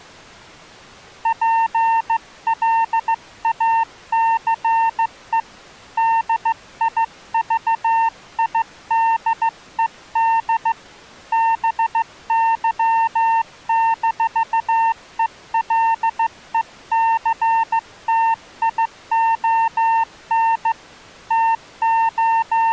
Morse code, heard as a keyed tone, hand-sent with a straight key, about 15 wpm, 910 Hz. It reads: PLACE DIVIDED BY-ELECTION …